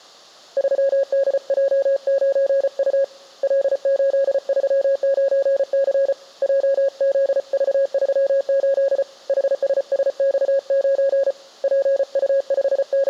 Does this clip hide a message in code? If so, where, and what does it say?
Yes: Morse code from 0.5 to 13.1 s, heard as a keyed tone, hand-sent with a paddle, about 34 wpm, 550 Hz. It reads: 3DJ9U L839C JZV38 HSSX9 …